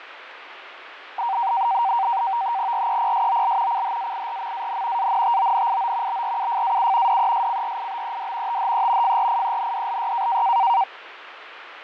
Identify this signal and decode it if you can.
NAVTEX (SITOR-B), 100 baud, 170 Hz shift, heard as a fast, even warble, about 860 Hz centre, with radio static and fading. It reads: REPSOL CHAIRMAN ANTONIO BRUFAU DESCRIBED THE FRIENDLY